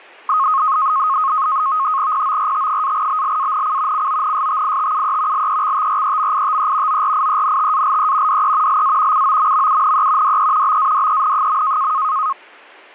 NAVTEX (SITOR-B), 100 baud, 170 Hz shift, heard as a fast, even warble, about 1170 Hz centre. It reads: PORT-BLANC CONSTITUE LEXTREMITE ORIENTALE DE LA COMMUNE DE BADEN.